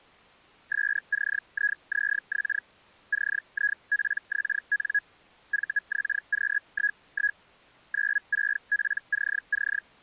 Hellschreiber (Feld-Hell, 122.5 baud), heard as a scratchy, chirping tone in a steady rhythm, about 1650 Hz. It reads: SCIZX CIPXN VXQ11 96PCC